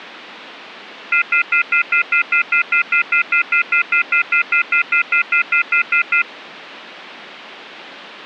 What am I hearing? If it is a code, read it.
Telephone call progress tone (North American plan), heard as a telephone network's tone, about 1400, 2050, 2450, 2600 Hz, 0.1 s on and 0.1 s off. Off-hook warning tone.